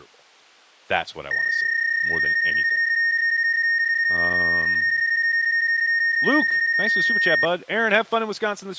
PSK31 (31.25 baud), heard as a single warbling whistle, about 1850 Hz, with speech in English.